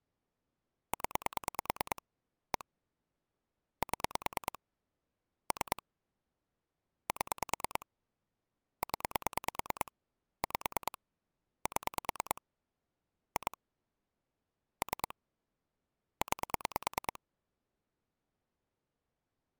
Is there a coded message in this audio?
Yes: pulse dialling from 0.9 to 17.2 s, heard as clicks on a phone line, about 9 pulses a second. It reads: 0 1 7 3 7 0 5 7 2 3 9